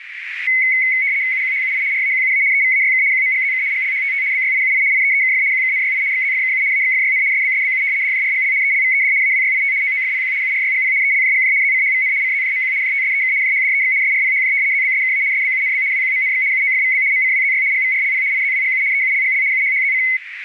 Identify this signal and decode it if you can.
RTTY (75 baud, 170 Hz shift), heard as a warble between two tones, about 2150 Hz centre, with radio static and a narrow filter. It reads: UQHUI RAQUA EVAYK QMGZK GLHTT BYIUI IEEKF QKNYI XZFKU AXFYN SBSBU DJRGL ELVED AWYIT OOFPQ URYGP ELJGJ ZCHVN CZJMQ JTSEK JHDEX SRPHJ ZBSKA SBUNB WQMNX UOFVB MCWZY GVRLP IZWGU EULGL UHHZC